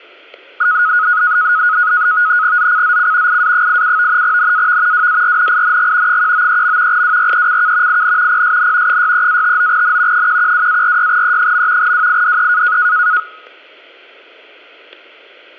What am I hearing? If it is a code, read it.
NAVTEX (SITOR-B), 100 baud, 170 Hz shift, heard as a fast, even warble, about 1360 Hz centre, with static crashes. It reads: ZCZC IA87 NAV WARNING 193. WRECK IN PSN 63-59N 112-46E. WIDE